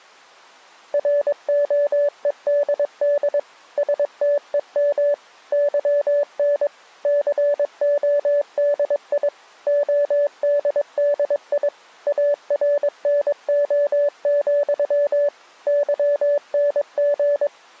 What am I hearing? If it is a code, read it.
Morse code, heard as a keyed tone, machine-sent, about 22 wpm, 580 Hz. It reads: ROEDD STEM YN CODI ODDI ARNO, YNG